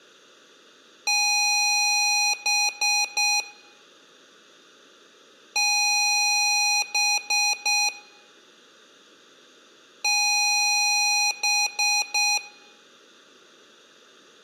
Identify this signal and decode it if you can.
Beep code, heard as beeps from a small speaker, played three times, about 830 Hz, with room echo. 1 long, 3 short. In Award and IBM BIOS tables: video adapter failure; in AMI BIOS tables: memory failure.